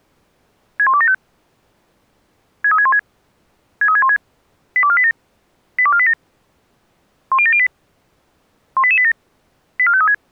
Five-tone selective call (ZVEI), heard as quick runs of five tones, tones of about 70 ms. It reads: 61275 63616 63616 82487 82487 10708 18887 84536